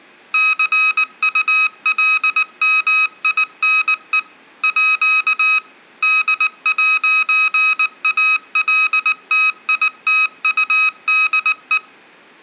Morse code (with French letters), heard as electronic beeps, machine-sent, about 19 wpm, 1270 Hz, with room echo. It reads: CULMINE À D'ALTITUDE